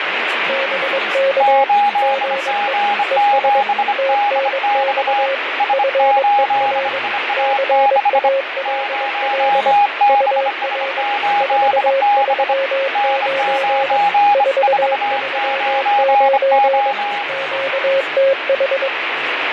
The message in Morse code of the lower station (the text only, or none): BK GE ES TNX FER CALL UR 439 439 QTH